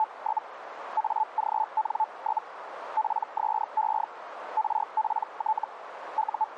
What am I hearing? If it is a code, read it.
Hellschreiber (Feld-Hell, 122.5 baud), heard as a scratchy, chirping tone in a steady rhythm, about 870 Hz, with radio static and a narrow filter. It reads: … AGN? PSE RPT …